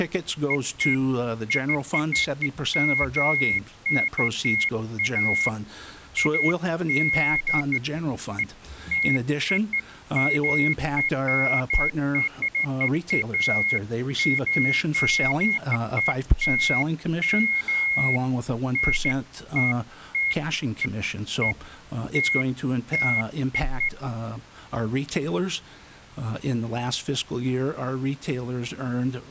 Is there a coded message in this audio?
No, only beeps of irregular length.